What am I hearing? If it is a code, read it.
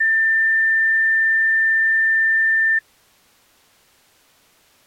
A steady tone. There is no code.